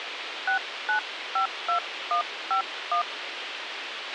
DTMF, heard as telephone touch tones, dialled by hand, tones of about 100 ms, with radio hiss and a squelch burst at the end. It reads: 6952151